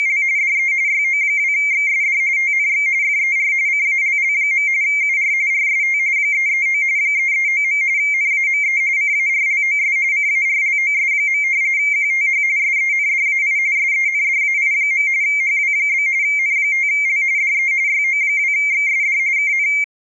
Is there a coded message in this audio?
Yes: RTTY (45.45 baud, 170 Hz shift) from 0.0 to 19.8 s, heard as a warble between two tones, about 2200 Hz centre. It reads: … DE YO2XSD TNX FER CALL. UR RST 339 339. NAME CARLOS CARLOS. QTH SENDAI SENDAI. HW? N5L DE YO2XSD KN